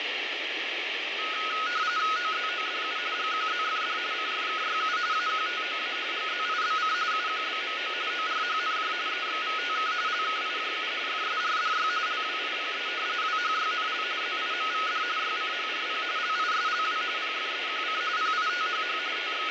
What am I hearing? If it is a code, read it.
RTTY (45.45 baud, 170 Hz shift), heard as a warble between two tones, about 1360 Hz centre, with radio static and fading. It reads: OZODU GQZFD CFKYU AQTOA GZIBC UQBMO ORHNJ EXVTK LKIJU FSRDY LWIPE WHYNL ZIMVD YCHRP LISLW PFEQC PITHH …